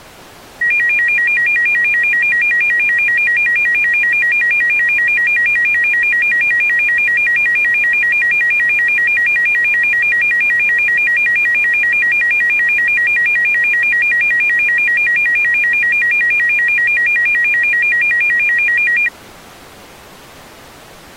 A tone that alternates evenly between two pitches. There is no code.